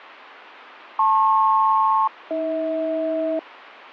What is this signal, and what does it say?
Aircraft SELCAL, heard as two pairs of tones, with radio static. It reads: LP-AH